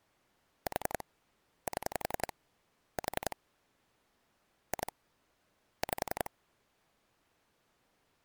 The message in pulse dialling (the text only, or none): 4 7 4 2 5